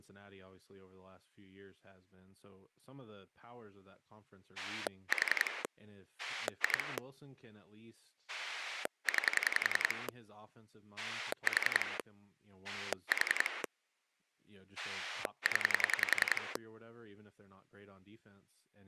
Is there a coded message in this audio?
Yes: pulse dialling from 4.6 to 16.6 s, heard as a rotary dial, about 10 pulses a second, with speech in English. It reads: 4 2 9 4 4 0